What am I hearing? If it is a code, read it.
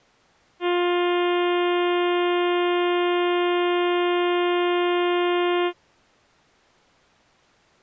Ship horn signal, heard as a ship's horn, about 350 Hz. 1 long. At sea: a vessel nearing a blind bend, or under power and making way in fog.